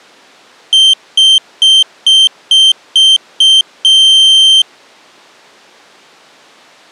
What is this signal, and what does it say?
Beep code, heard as a piezo beeper, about 3150 Hz. 7 short, 1 long.